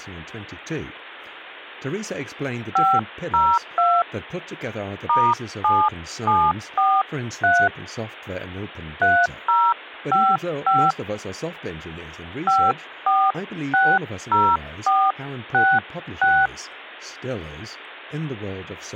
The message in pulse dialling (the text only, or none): none